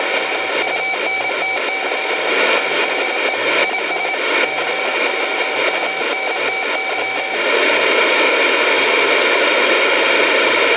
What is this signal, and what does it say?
Morse code, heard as a keyed tone, machine-sent, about 27 wpm, 760 Hz, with radio static and speech in Sanskrit. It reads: … THE IS COUNTY